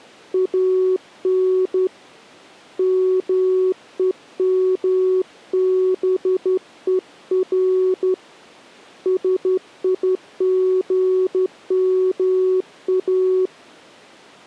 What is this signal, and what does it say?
Morse code, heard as a keyed tone, hand-sent with a straight key, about 12 wpm, 370 Hz. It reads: AN MEMBER SIGMA